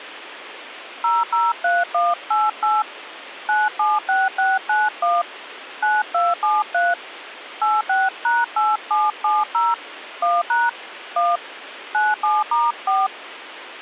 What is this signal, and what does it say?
DTMF, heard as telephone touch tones, dialled by hand, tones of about 200 ms, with phone line noise. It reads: 003188 976691 9273 86#8770 1# 1 97*4